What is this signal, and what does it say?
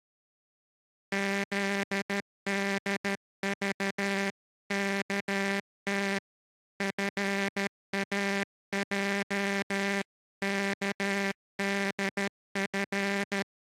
Morse code (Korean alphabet), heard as a buzzer, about 13 wpm. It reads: 틀어 놓은